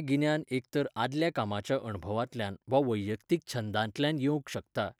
Speech in Goan Konkani. There is no code.